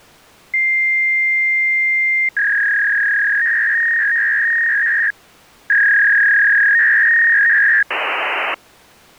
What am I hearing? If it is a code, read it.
Fax machine handshake, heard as a long tone, a warble and hiss.